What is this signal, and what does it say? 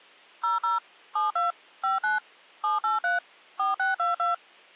DTMF, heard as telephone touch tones, dialled by machine, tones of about 150 ms. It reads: 00 72 59 783 4622